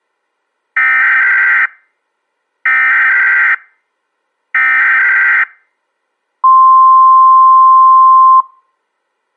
Emergency Alert System (SAME) tones (header bursts, then the 1050 Hz attention tone), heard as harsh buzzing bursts, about 520.83 baud.